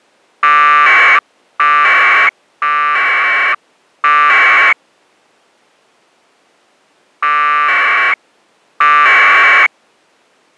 Packet radio (AX.25, as in APRS), 1200 baud, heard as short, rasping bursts.